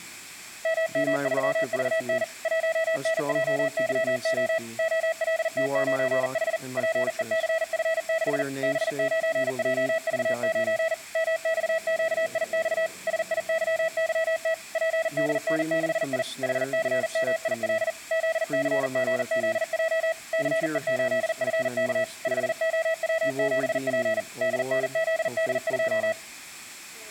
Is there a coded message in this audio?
Yes: Morse code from 0.6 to 26.2 s, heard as a keyed tone, machine-sent, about 40 wpm, 650 Hz. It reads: MM3VN 1NJYO OLT9H PECF6 B9JV9 MXQIX SIYYT PDN6I HCMIL ZCGZJ CE8FK 5OW7P DNZD2